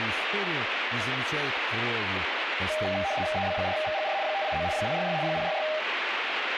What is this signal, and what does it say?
RTTY (75 baud, 170 Hz shift), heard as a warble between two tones, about 700 Hz centre, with radio static. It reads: EB4VGR 589 066 066